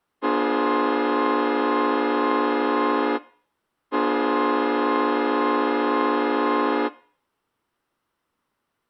Train horn signal, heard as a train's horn. 2 long. On North American railways: brakes released, proceed.